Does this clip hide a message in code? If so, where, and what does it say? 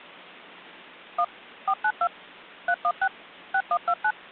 Yes: DTMF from 1.2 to 4.1 s, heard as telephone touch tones, dialled by machine, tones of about 60 ms. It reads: 1 492 316 6129